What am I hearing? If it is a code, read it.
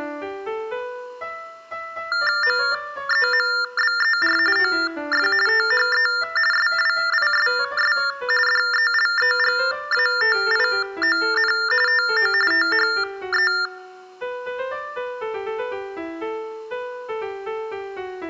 TTY/TDD text telephone tones (45.45 baud Baudot), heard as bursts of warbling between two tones, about 400 Hz shift, 1600 Hz centre. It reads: MEMBER OF THE SWISS DELEGATION TO THE